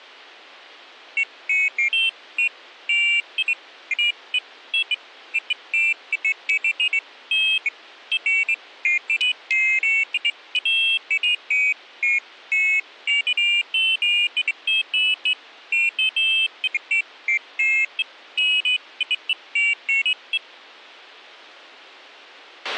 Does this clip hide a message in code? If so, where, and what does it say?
No, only pairs of high tones at irregular times, with a squelch burst at the end.